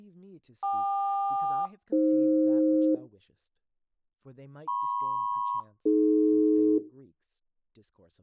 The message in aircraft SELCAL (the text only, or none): KQ-AF MP-AD